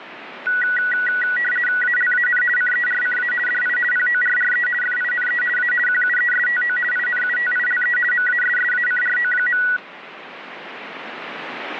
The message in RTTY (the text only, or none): ALAN CERCA DI PORRE FINE A QUESTO INUTILE MASSACRO.